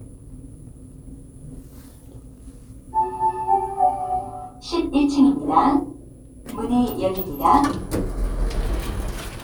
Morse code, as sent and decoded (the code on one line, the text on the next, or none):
none